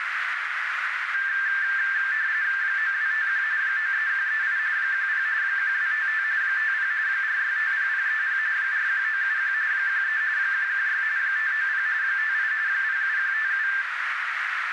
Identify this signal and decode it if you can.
RTTY (45.45 baud, 170 Hz shift), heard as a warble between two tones, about 1650 Hz centre, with radio static and a narrow filter. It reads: 9251 93138 10 1255 50 4650030 41971 13 116 590 58 07157